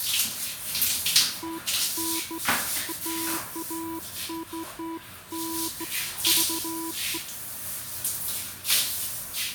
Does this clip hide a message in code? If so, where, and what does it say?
No, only beeps of irregular length, with room echo and the noise of a restroom.